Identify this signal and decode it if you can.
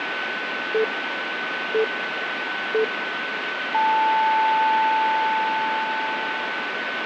Radio time signal (three low pips and a long one an octave up, as on NHK), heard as pips, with radio static and a steady whistle near 1510 Hz.